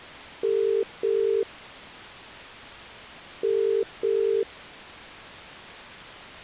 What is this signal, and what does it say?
Telephone call progress tone (as in the UK, Ireland, Australia and similar networks), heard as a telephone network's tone, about 400, 450 Hz. Ringback tone.